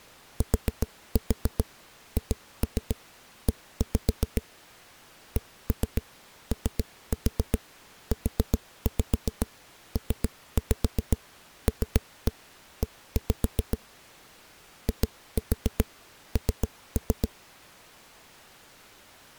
Tap code, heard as knocks on a wall, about 7 knocks a second. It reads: THE COUPLE IN